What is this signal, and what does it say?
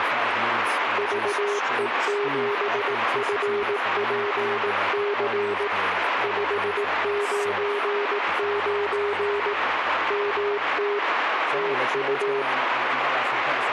Morse code, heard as a keyed tone, hand-sent with a paddle, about 18 wpm, 410 Hz, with radio static and speech in English. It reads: VE7FPC 599 MT TU